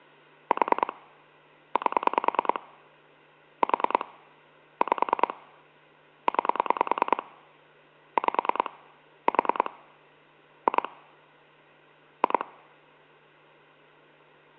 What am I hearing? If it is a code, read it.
Pulse dialling, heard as clicks on a phone line, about 10 pulses a second, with hum. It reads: 4 8 4 5 9 5 4 2 2